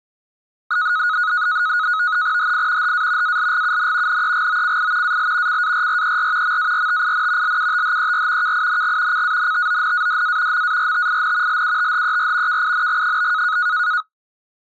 NAVTEX (SITOR-B), 100 baud, 170 Hz shift, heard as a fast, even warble, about 1360 Hz centre. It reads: HI HA ALGUN NEGOCI AL CARRER MARTIN LUTHER KING CANTONADA MARTIN LUTHER KING?